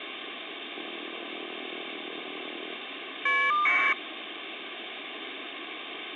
Caller ID data burst, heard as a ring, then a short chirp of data, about 1200 baud, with phone line noise.